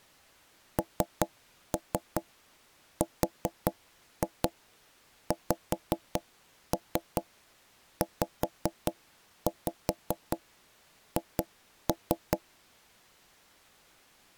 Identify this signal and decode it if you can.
Tap code, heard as knocks on wood, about 5 knocks a second. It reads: NRXZH